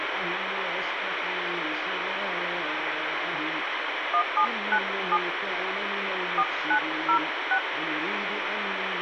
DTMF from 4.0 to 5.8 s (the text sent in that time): 1797